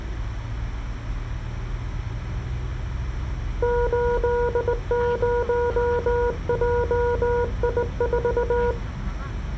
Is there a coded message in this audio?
Yes: Morse code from 3.6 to 8.8 s, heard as a keyed tone, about 19 wpm, 480 Hz, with the noise inside a car. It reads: 80JI4